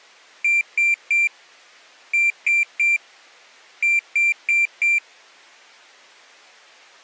Beep code, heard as a piezo beeper, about 2350 Hz. 3-3-4. In Phoenix BIOS tables: video failure.